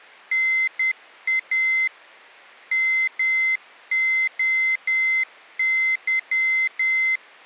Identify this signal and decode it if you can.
Morse code (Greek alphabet), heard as a high beeper, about 10 wpm, 2050 Hz. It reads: ΝΑ ΜΟΥ